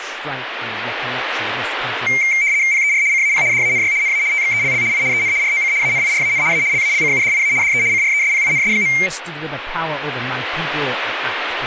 RTTY (75 baud, 170 Hz shift), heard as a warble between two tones, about 2200 Hz centre, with radio static and speech in English. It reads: PER CAP DANY NA TXELL I EN ROC ANIRAN A LALCUDIA DE CRESPINS.